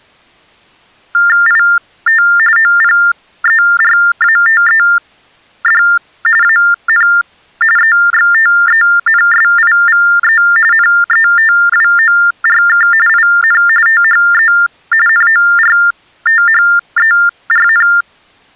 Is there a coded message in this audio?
Yes: TTY/TDD text telephone tones (45.45 baud Baudot) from 1.1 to 18.0 s, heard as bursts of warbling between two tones, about 400 Hz shift, 1600 Hz centre. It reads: IT OPERATED AN EXTENSIVE NETWORK IN THE NORTHERN